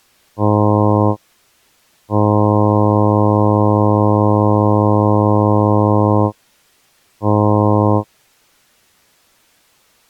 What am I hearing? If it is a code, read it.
Ship horn signal, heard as a ship's horn, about 100 Hz. 1 short, 1 long, 1 short. At sea: a vessel at anchor warns of its position.